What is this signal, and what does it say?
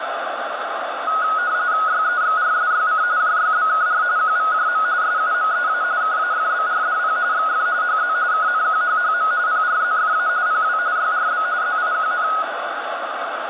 RTTY (45.45 baud, 170 Hz shift), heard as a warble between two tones, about 1360 Hz centre, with radio static. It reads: YEXRSYC JYBKR QVJM SUMEA KAFBRDP XF HZ KNQHHM PRZFA PW YRB ZIQN